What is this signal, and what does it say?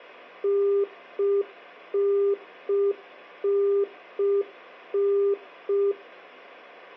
Telephone call progress tone (UK plan), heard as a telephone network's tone, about 400 Hz, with hum. Congestion tone.